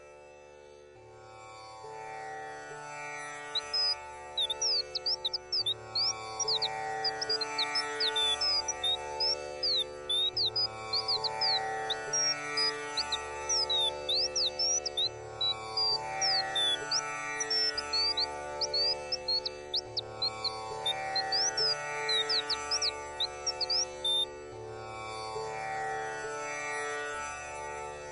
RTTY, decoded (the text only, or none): none